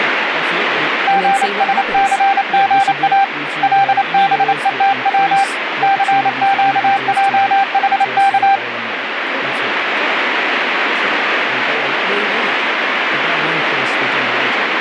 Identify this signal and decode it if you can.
Morse code, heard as a keyed tone, hand-sent with a paddle, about 28 wpm, 790 Hz, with radio static and speech in English. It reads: GSCGA LBETW CQJHK